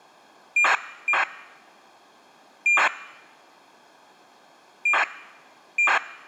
ACARS aircraft data, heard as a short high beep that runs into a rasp, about 2400 baud.